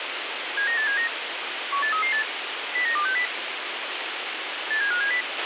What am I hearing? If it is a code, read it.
Five-tone selective call (CCIR), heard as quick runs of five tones, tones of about 100 ms, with radio hiss and a squelch burst at the end. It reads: 79879 18338 09260 87570